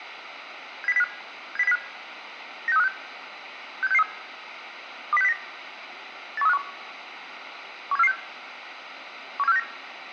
Five-tone selective call (EEA), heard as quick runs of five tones, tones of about 40 ms, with radio hiss. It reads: 70705 70705 96356 67663 20609 81351 17446 17469